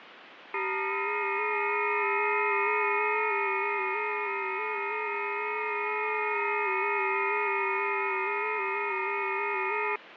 FT8 (several signals at once), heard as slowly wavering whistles, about 6.25 baud, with radio static.